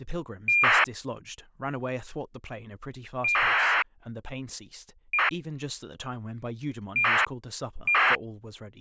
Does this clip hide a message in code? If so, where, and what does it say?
Yes: ACARS aircraft data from 0.5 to 8.2 s, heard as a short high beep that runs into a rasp, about 2400 baud, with speech in English.